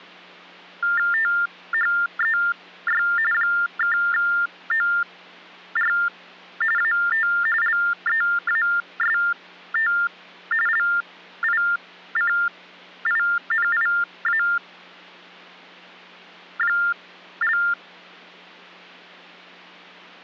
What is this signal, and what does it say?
TTY/TDD text telephone tones (45.45 baud Baudot), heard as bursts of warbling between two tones, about 400 Hz shift, 1600 Hz centre, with hum. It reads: THEY (OR AT LEAST LICINIA)